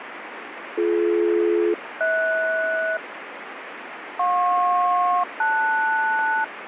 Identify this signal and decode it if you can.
Aircraft SELCAL, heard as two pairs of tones, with radio static. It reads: BD-HS JP-LS